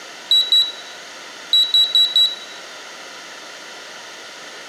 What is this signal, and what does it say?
Beep code, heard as a piezo beeper, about 3900 Hz, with room echo. 2-4.